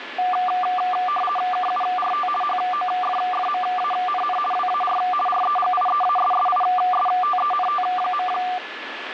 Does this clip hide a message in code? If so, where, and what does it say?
Yes: RTTY (50 baud, 450 Hz shift) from 0.2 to 8.6 s, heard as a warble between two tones, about 960 Hz centre, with radio static and a steady whistle near 1720 Hz. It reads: KURT HOFFMANN WAR REGIEASSISTENT.